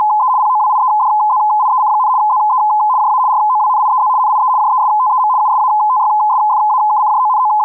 RTTY (75 baud, 170 Hz shift), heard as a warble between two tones, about 930 Hz centre. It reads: … POWIEDZIEC, ZE JA ROWNIEZ NIE JESTEM …